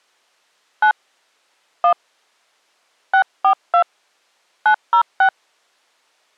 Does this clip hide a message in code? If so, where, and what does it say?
Yes: DTMF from 0.8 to 5.3 s, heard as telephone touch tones, dialled by hand, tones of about 90 ms. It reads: 9 1 642 906